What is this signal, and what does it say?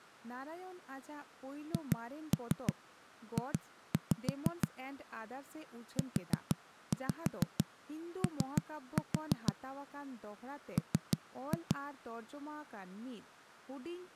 Tap code, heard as knocks on a wall, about 6 knocks a second, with speech in Santali. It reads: HJ UO M